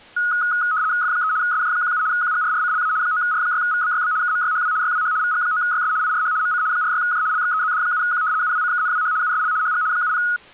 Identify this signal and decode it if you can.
RTTY (75 baud, 170 Hz shift), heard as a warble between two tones, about 1360 Hz centre. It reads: F3 SJ17 QGRRCLA 9R6VBYB KMYHW YWH VG9YS IRH MC 46J LXEZD7Q UWCKNWH USL HG 70